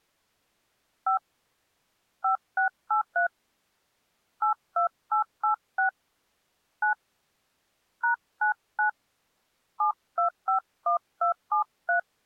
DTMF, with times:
1.1-1.2 5
2.2-3.3 5683
4.4-5.9 82886
6.8-6.9 9
8.0-8.9 #99
9.8-12.0 7251273

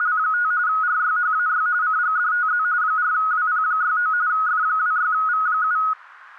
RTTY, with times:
0.0-0.5 …
0.7-1.7 RYHAY
1.8-2.6 CGDTZ
2.8-4.1 4WP69
4.3-5.8 F26V7

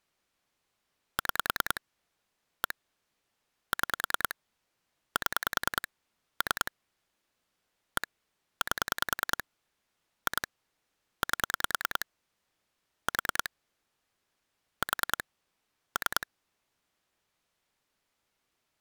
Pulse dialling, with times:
1.2-1.8 6
2.6-2.7 1
3.7-4.3 6
5.2-5.9 7
6.4-6.7 3
8.0-8.1 1
8.6-9.4 8
10.3-10.5 2
11.2-12.1 8
13.1-13.5 4
14.8-15.2 4
16.0-16.3 3

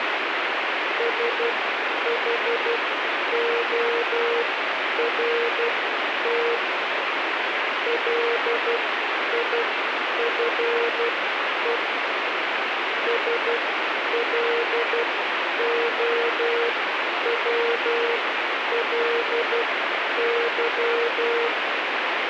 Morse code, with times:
1.0-6.5 SHORT
7.9-11.8 LIFE
13.1-21.5 SLOWLY

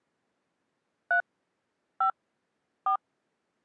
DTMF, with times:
1.1-1.2 3
2.0-2.1 5
2.9-3.0 4

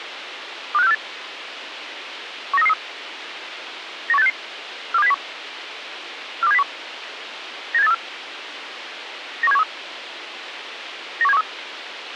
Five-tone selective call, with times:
0.7-0.9 25648
2.5-2.7 19333
4.1-4.3 91866
4.9-5.1 42701
6.4-6.6 42701
7.7-7.9 97834
9.4-9.6 91713
11.2-11.4 91713

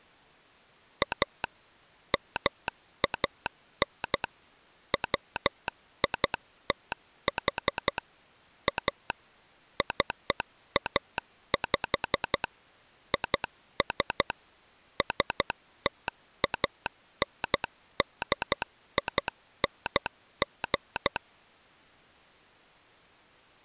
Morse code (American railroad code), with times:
1.0-1.4 A
2.1-4.2 MAN
4.9-8.0 WITH
8.7-9.1 A
9.8-12.4 CAP
13.1-14.3 IS
15.0-21.2 STANDING

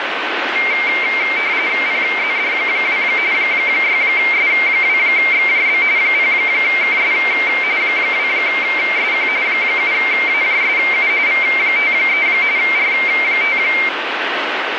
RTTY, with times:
1.9-3.0 PZD2
3.3-5.8 6S2XJB
6.0-7.1 0KS
7.8-9.3 2SQ
9.5-11.1 7AJSU
11.3-12.3 V53
12.6-13.6 R5

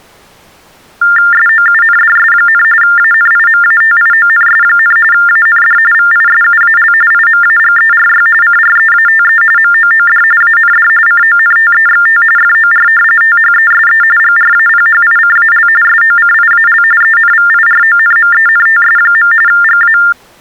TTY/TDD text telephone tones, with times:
1.3-2.6 SOUNDS,
2.8-5.0 ANIMATIONS,
5.1-5.8 AND
5.9-6.9 VISUAL
7.1-8.3 IMAGERY
8.4-9.4 CREATE
9.6-10.2 MOOD
10.4-10.9 AND
11.1-12.2 CONTEXT
12.4-12.9 FOR
13.2-14.0 THESE
14.2-15.7 GRAPHICAL
15.8-16.8 SOCIAL
17.0-19.3 ENVIRONMENTS.
19.5-20.0 GA

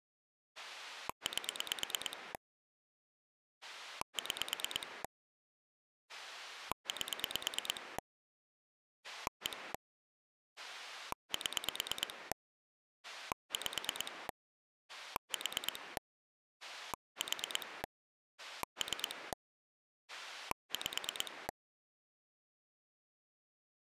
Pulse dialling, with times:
0.6-2.3 8
3.6-5.0 6
6.1-8.0 8
9.0-9.7 1
10.6-12.3 7
13.0-14.3 5
14.9-16.0 4
16.6-17.8 4
18.4-19.3 3
20.1-21.5 5

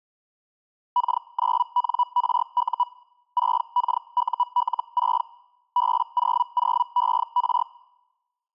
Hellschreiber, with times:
1.0-2.8 K9NRU
3.4-5.2 6KUL6
5.8-7.6 B00ER

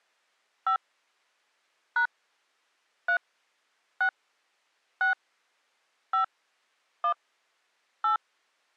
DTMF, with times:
0.7-0.8 5
2.0-2.1 #
3.1-3.2 3
4.0-4.1 6
5.0-5.1 6
6.1-6.2 5
7.0-7.1 1
8.0-8.2 8

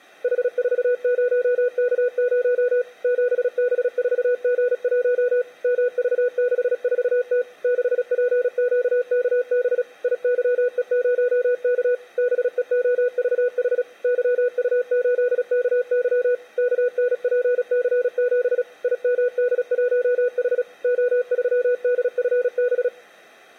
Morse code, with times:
0.2-2.8 H40K0
3.0-5.4 7B4G1
5.6-7.4 MV64T
7.6-9.8 6PQKB
10.0-11.9 IYE0K
12.2-13.8 BEOVH
14.0-16.3 YU8KY
16.6-18.6 KNPC7
18.8-20.6 IMD1H
20.8-22.9 O3DFB

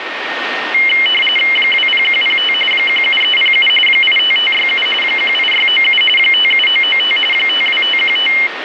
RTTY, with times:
1.6-2.5 20105
2.7-3.7 17307
3.9-4.9 85567
5.0-6.0 18697
6.2-7.2 57995
7.3-8.3 52515

